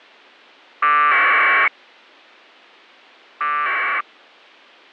Packet radio (AX.25, as in APRS), 1200 baud, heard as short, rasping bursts.